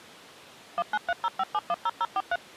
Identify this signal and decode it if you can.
DTMF, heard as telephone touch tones, dialled by machine, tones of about 40 ms. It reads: 19305710043